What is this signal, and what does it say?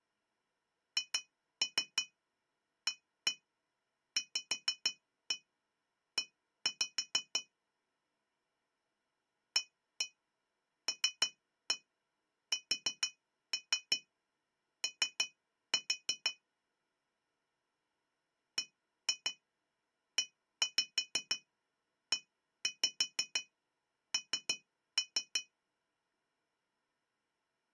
Tap code, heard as taps on glass, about 6 knocks a second. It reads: HAVE ALSO BEEN